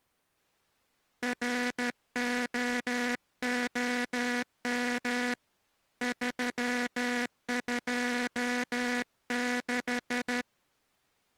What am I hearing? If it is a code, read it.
Morse code, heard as a buzzer, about 13 wpm. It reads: ROOM 326